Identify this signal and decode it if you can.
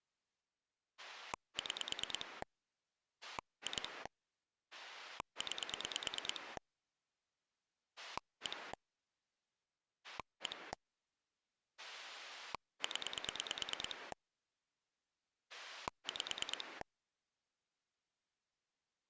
Pulse dialling, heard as a rotary dial, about 9 pulses a second. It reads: 6 2 9 1 1 0 5